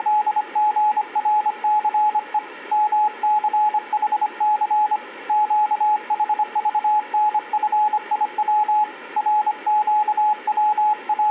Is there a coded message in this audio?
Yes: Morse code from 0.0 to 11.3 s, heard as a keyed tone, hand-sent with a paddle, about 25 wpm, 850 Hz, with room echo. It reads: … MCHC QHVNFIW …